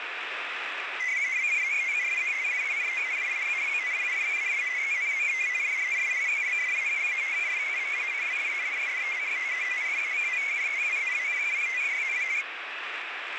Multi-tone FSK (Olivia or MFSK type), about 500 Hz wide, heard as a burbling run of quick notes, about 62.5 baud, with radio static.